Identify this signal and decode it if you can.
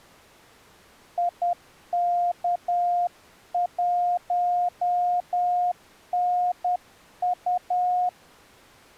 Morse code, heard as a keyed tone, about 10 wpm, 710 Hz. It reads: IK1NU